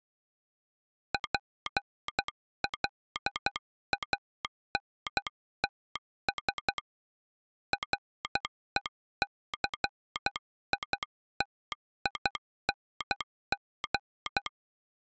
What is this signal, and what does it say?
Morse code, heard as a telegraph sounder, hand-sent with a paddle, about 12 wpm. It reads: PLANTS RECITING